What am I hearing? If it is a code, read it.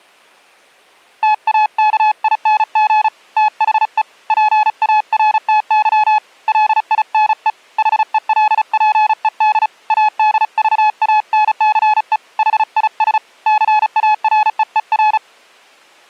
Morse code, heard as a keyed tone, hand-sent with a paddle, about 35 wpm, 850 Hz. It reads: TAKING THE PARTY LINE HELPED ADVANCE HIS CAREER